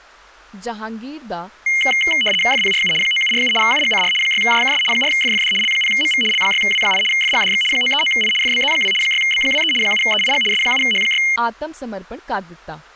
RTTY (75 baud, 850 Hz shift), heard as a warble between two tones, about 2550 Hz centre, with speech in Punjabi. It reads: FPRU 9747 UGCR 6JKS 4FFD L0MV L6W8 FGDX 939I FBZ2 6B23 7EIG S7H6